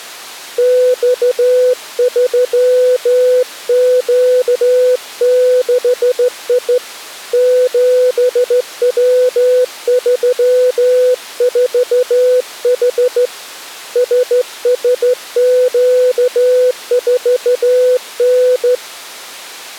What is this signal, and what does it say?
Morse code, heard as a keyed tone, hand-sent with a straight key, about 14 wpm, 500 Hz. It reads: X3Q6I 7W34H SSQ4N